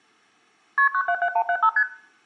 Multi-frequency trunk signalling (R1, as on North American trunks), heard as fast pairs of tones, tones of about 70 ms, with room echo. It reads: KP 977175 ST